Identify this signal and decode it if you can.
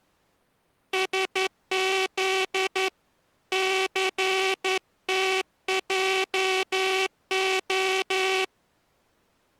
Morse code (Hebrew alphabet), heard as a buzzer, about 11 wpm. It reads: שז סתעה